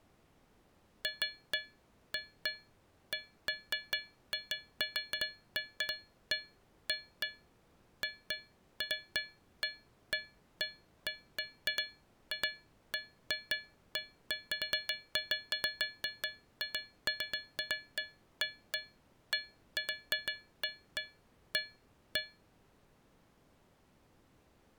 Irregular taps on a metal pipe. There is no code.